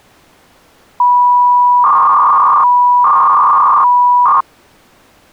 300-baud modem data (V.21 tones), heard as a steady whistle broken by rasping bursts, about 300 baud, 200 Hz shift.